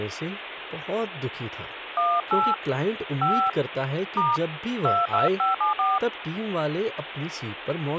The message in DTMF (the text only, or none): 18 5 * 22574